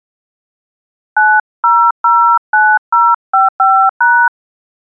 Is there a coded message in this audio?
Yes: DTMF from 1.2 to 4.3 s, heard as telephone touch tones, dialled by hand, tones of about 270 ms. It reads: 9009055#